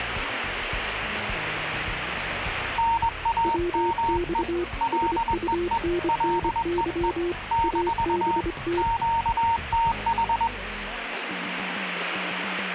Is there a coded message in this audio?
Yes: Morse code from 2.7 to 10.5 s, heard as two keyed tones, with radio static. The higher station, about 21 wpm, 920 Hz: NAME LEE LEE - QTH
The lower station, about 25 wpm, 350 Hz: WX SUNNY ABT